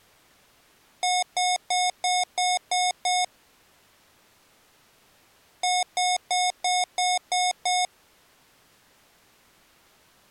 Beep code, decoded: 7 short

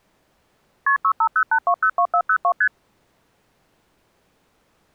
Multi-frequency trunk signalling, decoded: KP 6508202402 ST

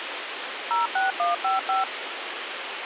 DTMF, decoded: 06155

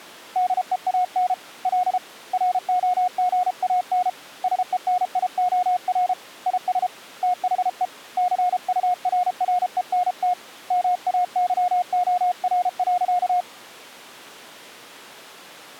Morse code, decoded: DEAN L ROGAN SENIOR IS THE CURRENT MAYOR.

